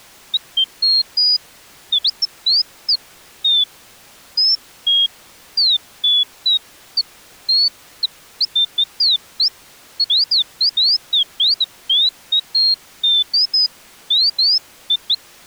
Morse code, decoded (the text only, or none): none